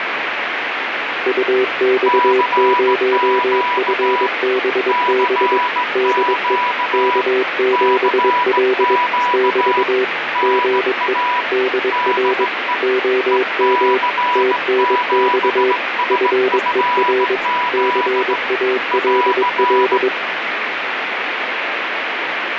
Morse code, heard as two keyed tones, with radio static. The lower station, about 22 wpm, 380 Hz: UX0FBB DE K7L <BT> GE DR OM TNX FER CALL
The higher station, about 17 wpm, 980 Hz: CQ CQ CQ NA DE EC7SFZ <AR>